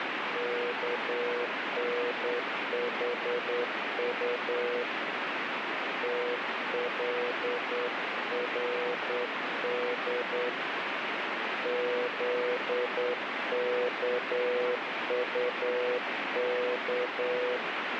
Morse code, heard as a keyed tone, hand-sent with a straight key, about 9 wpm, 490 Hz, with heavy radio static. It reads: KNHU TLRD ZKUK